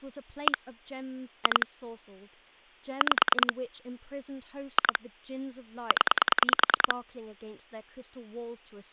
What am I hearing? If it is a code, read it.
Pulse dialling, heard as clicks on a phone line, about 10 pulses a second, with speech in English. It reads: 1 2 5 2 0